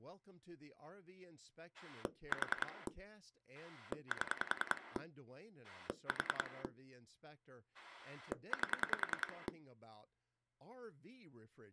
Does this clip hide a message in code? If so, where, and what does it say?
Yes: pulse dialling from 1.7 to 9.5 s, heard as a rotary dial, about 10 pulses a second, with speech in English. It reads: 4 7 4 8